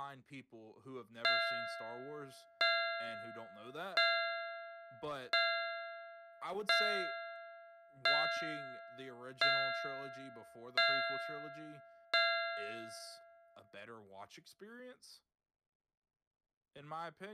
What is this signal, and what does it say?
Clock strike, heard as a bell, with speech in English. 9. Nine o'clock.